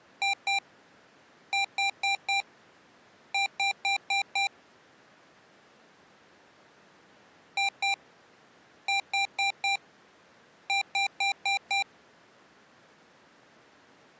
Beep code, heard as beeps from a small speaker, played twice, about 790 Hz. 2-4-5.